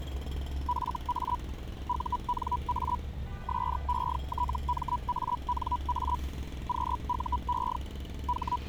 Hellschreiber (Feld-Hell, 122.5 baud), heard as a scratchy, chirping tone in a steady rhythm, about 980 Hz, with street noise. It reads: FA UNA SETMANA QUE …